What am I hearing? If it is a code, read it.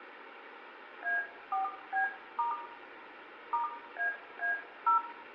DTMF, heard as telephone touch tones, dialled by hand, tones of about 130 ms, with phone line noise and room echo. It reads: A4B* *AA0